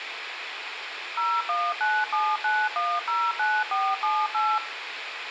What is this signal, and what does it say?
DTMF, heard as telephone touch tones, dialled by machine, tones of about 240 ms, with radio hiss, a squelch burst at the end and room echo. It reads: 01979109478